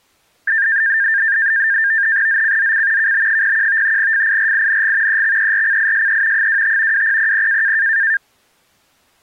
NAVTEX (SITOR-B), 100 baud, 170 Hz shift, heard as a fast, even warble, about 1700 Hz centre. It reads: ZCZC KB01 FIRING EXERCISE 25 2000